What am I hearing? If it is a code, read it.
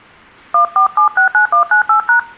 DTMF, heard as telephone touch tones, dialled by hand, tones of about 110 ms. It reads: 14769198#